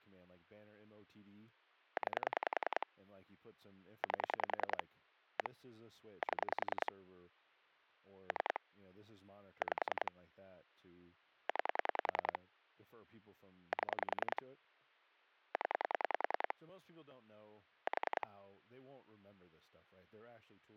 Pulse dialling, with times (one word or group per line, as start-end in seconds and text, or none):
2.0-2.9 9
4.0-4.8 8
5.4-5.5 1
6.2-6.9 7
8.3-8.6 3
9.6-10.1 5
11.5-12.4 9
13.7-14.4 7
15.5-16.5 0
17.9-18.3 4